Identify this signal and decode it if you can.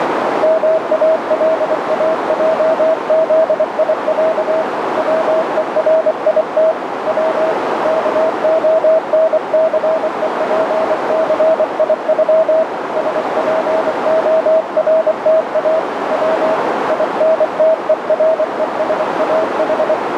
Morse code (Russian alphabet), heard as a keyed tone, hand-sent with a paddle, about 24 wpm, 640 Hz, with heavy radio static and a narrow filter. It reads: МАЛАЙЗИЯ ВЕРИТ В КОНЦЕПЦИЮ СПОРТА В ИНТЕРЕСАХ